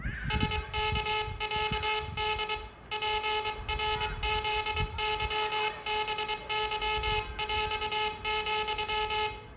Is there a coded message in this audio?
Yes: Morse code (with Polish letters) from 0.2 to 9.3 s, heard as a buzzer, hand-sent with a paddle, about 23 wpm, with room echo and the noise of a park. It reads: SKĄD PRZYBYŁ,